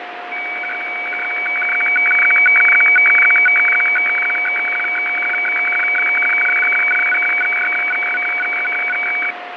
Weather fax (radiofax), 120 lines a minute, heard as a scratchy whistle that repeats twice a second, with radio static, fading and a steady whistle near 710 Hz.